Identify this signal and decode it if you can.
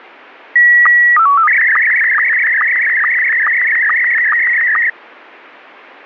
SSTV (slow-scan television), Scottie S1, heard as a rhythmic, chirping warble, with radio static.